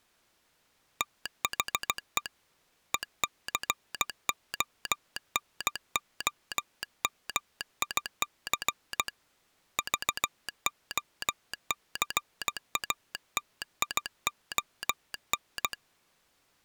Morse code, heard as a telegraph sounder, hand-sent with a paddle, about 16 wpm. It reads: THE ECONOMIC VOCATION